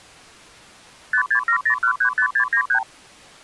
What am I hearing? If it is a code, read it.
Multi-frequency trunk signalling (R2, with the far end's replies), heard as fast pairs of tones, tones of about 90 ms. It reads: 5670135693